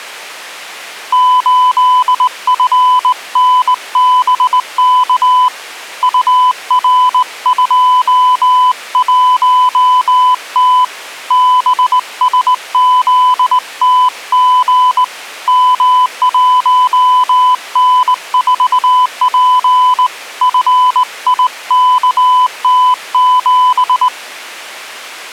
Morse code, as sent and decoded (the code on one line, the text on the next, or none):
---.. ..-. -. -... -.- / ..- .-. ..--- .---- - / -... ... --.. - --. / -- .---- -. ....- .--. / ..-. .. -.- - --...
8FNBK UR21T BSZTG M1N4P FIKT7